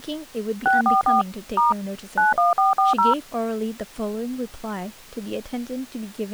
DTMF, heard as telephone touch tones, dialled by machine, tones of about 150 ms, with speech in English. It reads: 644 * 91440